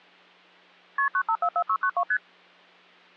Multi-frequency trunk signalling (R1, as on North American trunks), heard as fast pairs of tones, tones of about 70 ms. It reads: KP 9544692 ST